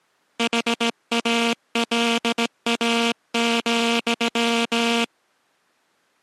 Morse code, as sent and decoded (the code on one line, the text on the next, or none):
.... .- .-.. .- --..--
HALA,